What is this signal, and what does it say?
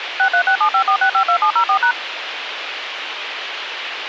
DTMF, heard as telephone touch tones, dialled by machine, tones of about 90 ms, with radio hiss and a squelch burst at the end. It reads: 636754652704#